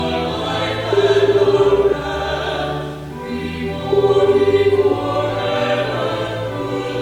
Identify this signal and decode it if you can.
Telephone call progress tone (Japanese plan), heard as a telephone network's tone, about 380, 400, 420 Hz, 1 s on and 2 s off. Ringback tone.